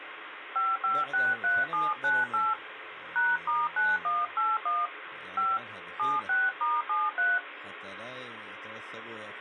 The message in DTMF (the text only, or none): 5563798 #*9181 5 76*73